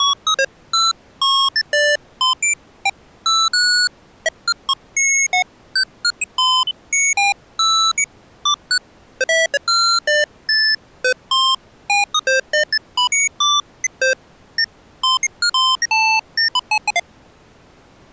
Electronic bleeps of random pitch and length. There is no code.